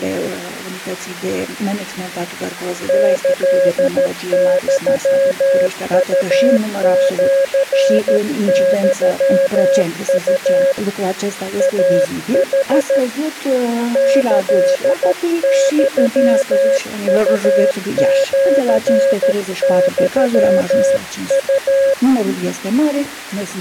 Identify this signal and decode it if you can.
Morse code (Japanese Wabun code), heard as a keyed tone, hand-sent with a paddle, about 13 wpm, 550 Hz. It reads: キユウシユウ イヌ キユウシユウ